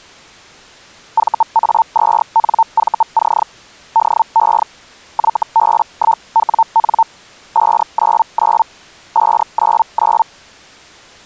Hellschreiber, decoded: VA2NVC DE YB1WN 599 599

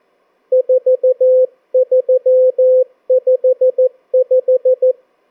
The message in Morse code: 4355

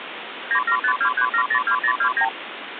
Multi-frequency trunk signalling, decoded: 97523702029

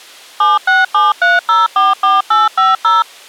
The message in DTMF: 7673044850

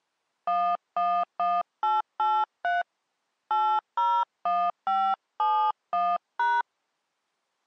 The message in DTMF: 111883 801571#

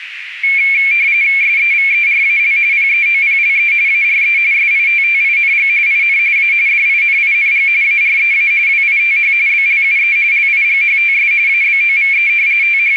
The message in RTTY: SEVERAL PEOPLE ARE SITTING IN A DINING AREA WITH BLUE LIGHTS ABOVE …

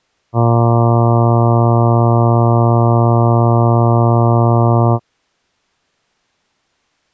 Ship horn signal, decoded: 1 long

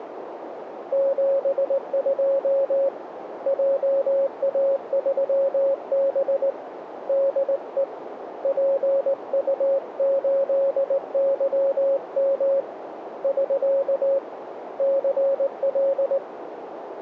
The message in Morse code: 72 JA3B DE PU8YM <SK> CL

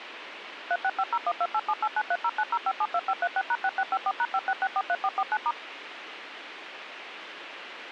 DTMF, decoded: 36501287893090572536#6654#56643449*

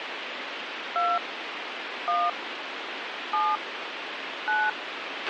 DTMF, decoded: 2 1 7 9

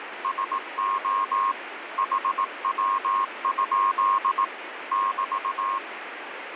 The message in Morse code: SO HW? <BT>

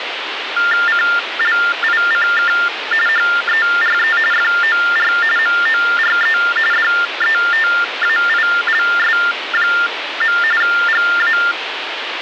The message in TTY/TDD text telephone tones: CLICK HERE FOR MORE DETAILS. GA

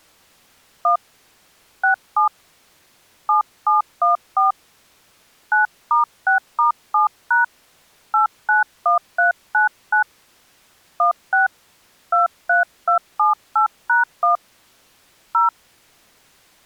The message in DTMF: 1 67 7714 9*6*7# 891399 16 23278#1 0

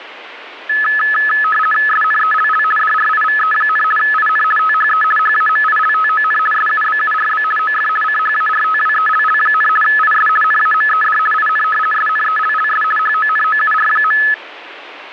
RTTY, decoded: SNELL DRIVE, IN THE HAMILTON SUBURB OF CHARTWELL, IS NAMED IN SNELLS HONOUR.

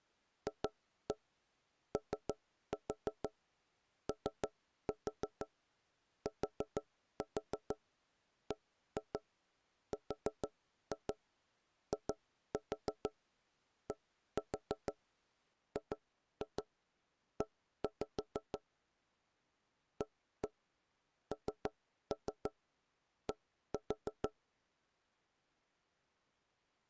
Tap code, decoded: FOOTBRIDGE AND

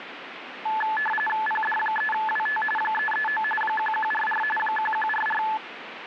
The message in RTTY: PD3WT 339 1144 1144

